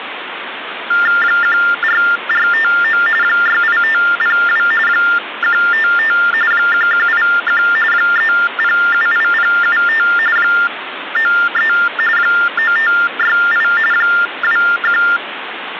TTY/TDD text telephone tones (45.45 baud Baudot), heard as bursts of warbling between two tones, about 400 Hz shift, 1600 Hz centre, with phone line noise. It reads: 14459 68502 155 1181 3078075 93 9568 21